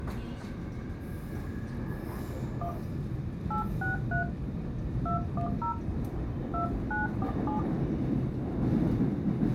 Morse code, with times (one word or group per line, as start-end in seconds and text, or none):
none